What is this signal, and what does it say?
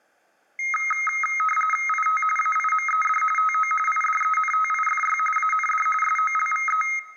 RTTY (45.45 baud, 850 Hz shift), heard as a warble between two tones, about 1700 Hz centre, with room echo. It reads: IT AIMED TO IDENTIFY AND SOLVE